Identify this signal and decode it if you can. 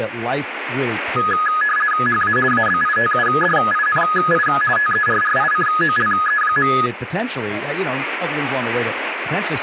RTTY (50 baud, 450 Hz shift), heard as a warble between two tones, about 1470 Hz centre, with radio static and speech in English. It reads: HA ABITUDINI TERRICOLE.